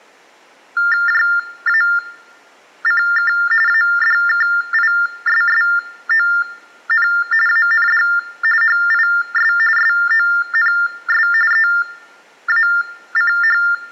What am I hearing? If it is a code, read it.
TTY/TDD text telephone tones (45.45 baud Baudot), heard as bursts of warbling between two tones, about 400 Hz shift, 1600 Hz centre. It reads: JACK ADKISSON AND HIS SONS EACH